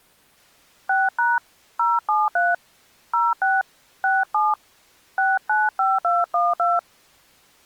DTMF, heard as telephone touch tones, dialled by hand, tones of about 200 ms. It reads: 6# 073 06 67 695212